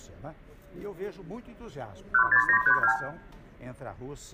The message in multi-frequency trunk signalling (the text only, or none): 16932